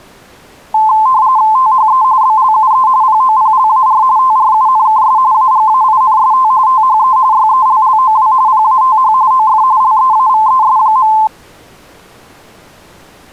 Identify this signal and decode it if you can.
RTTY (45.45 baud, 170 Hz shift), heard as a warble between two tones, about 960 Hz centre. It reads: THE BLUE POPLAR TRUNKS AGAINST THE YELLOW PATH OF LEAVES.